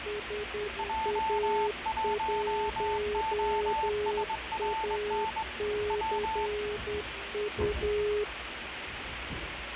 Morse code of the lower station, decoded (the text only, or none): SA1ACU